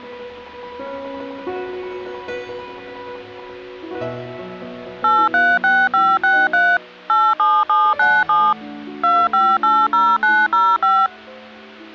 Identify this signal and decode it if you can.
DTMF, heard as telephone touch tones, dialled by machine, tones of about 240 ms. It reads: 836563 87797 2580905